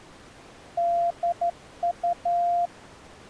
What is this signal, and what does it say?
Morse code, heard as a keyed tone, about 12 wpm, 690 Hz. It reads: DU